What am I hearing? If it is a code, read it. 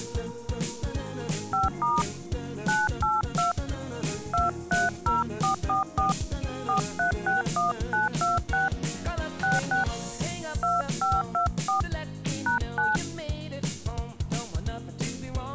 DTMF, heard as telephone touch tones, dialled by hand, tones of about 160 ms. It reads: 5* 982 230444 4361926 66 2524 #9